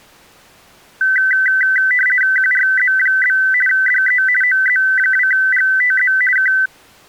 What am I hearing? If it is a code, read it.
RTTY (50 baud, 450 Hz shift), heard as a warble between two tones, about 1750 Hz centre. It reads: QRZ? DE OZ2GTZ K